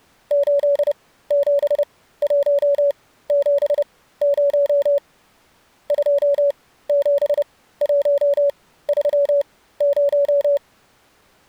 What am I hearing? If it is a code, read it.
Morse code, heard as a keyed tone, machine-sent, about 30 wpm, spaced as for 16 wpm, 560 Hz. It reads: 87170 27130